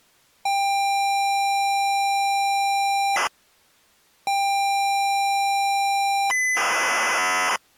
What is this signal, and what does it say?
ZX Spectrum tape loading, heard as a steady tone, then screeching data.